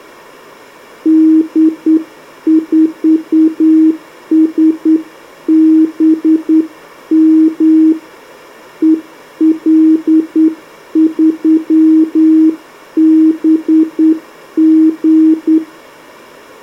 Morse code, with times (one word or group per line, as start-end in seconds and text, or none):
1.1-7.9 D4SBM
8.8-15.6 EL3BG